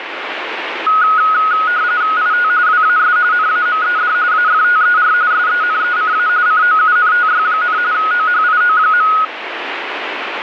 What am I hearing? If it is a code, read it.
RTTY (45.45 baud, 170 Hz shift), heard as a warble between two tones, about 1360 Hz centre, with radio static. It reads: IT WAS NAMED AFTER SENECA COUNTY, OHIO.